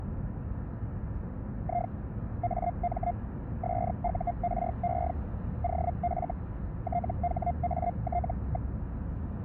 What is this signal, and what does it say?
Hellschreiber (Feld-Hell, 122.5 baud), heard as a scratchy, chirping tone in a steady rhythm, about 700 Hz, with the noise inside a car. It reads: I AM SURE OF THAT.